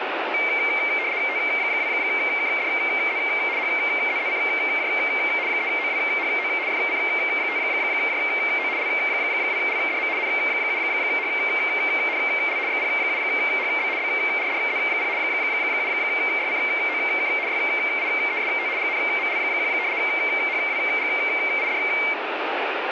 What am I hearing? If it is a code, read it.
RTTY (75 baud, 170 Hz shift), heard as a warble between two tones, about 2200 Hz centre, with radio static. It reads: T2KDZ HZZCJ 3OWHO FC5JO L2LDM N7HNL XP7HB BRDZ0 7YCOK YIEST GNML1 HWGID